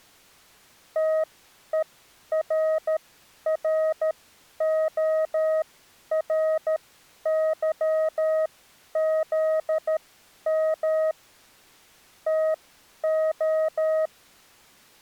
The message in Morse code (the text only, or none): TERRORYZM TO